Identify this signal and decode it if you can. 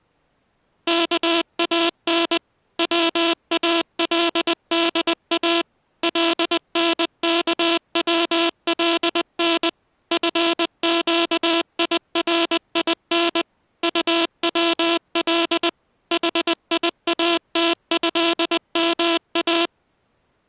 Morse code (Arabic alphabet), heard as a buzzer, machine-sent, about 20 wpm. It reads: كان والدا لنكولن فقيرين طول حياتهما